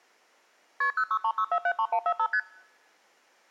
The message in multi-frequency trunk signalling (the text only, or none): KP 0636473145 ST